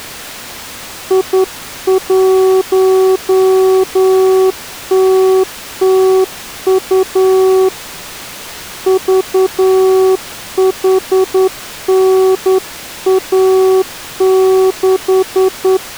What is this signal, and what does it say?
Morse code, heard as a keyed tone, hand-sent with a straight key, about 10 wpm, 380 Hz. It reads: I1TTU VHNA6